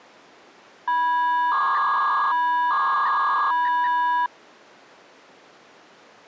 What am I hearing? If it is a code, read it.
300-baud modem data (V.21 tones), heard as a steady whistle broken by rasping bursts, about 300 baud, 200 Hz shift.